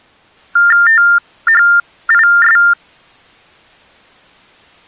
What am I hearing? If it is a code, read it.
TTY/TDD text telephone tones (45.45 baud Baudot), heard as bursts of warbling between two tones, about 400 Hz shift, 1600 Hz centre. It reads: THIS